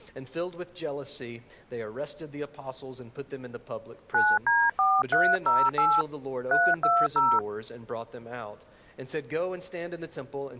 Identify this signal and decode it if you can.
DTMF, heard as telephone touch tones, dialled by hand, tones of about 230 ms. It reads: 9D4308 320